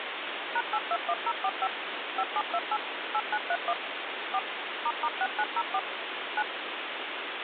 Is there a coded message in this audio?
Yes: DTMF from 0.6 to 6.4 s, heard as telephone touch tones, dialled by machine, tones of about 50 ms, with phone line noise. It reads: #821045 5728 8931 4 **6904 9